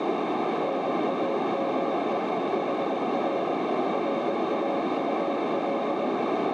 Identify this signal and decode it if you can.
Morse code, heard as a keyed tone, machine-sent, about 21 wpm, 550 Hz, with heavy radio static and a narrow filter. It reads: NAME HR RAUL